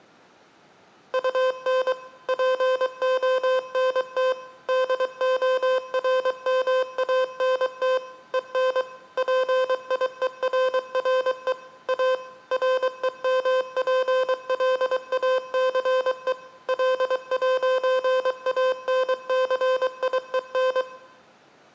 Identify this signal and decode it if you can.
Morse code, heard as electronic beeps, machine-sent, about 23 wpm, 520 Hz, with room echo. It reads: UN PONT DORMANT EN PIERRE A REMPLACE L'ANCIEN